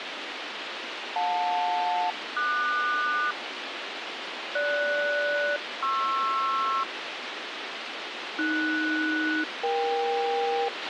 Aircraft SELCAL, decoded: JL-QS GS-PR AS-EK

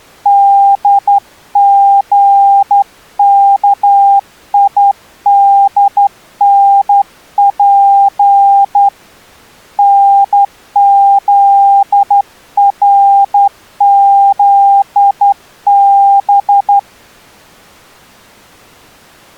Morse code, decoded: DGKIDNP NZRZB

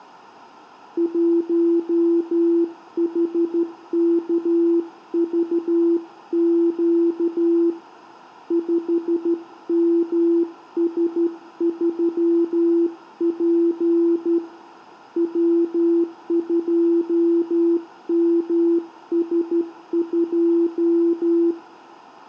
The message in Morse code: 1HKVQ 5MS3P W2MS2

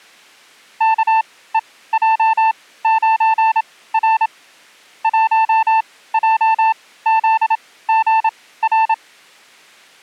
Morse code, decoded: KEJ9R 1JZGR

